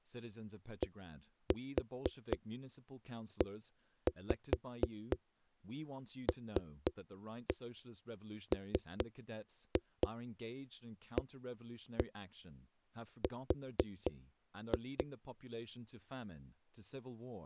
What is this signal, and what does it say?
Tap code, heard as knocks on a wall, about 4 knocks a second, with speech in English. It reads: DELMAR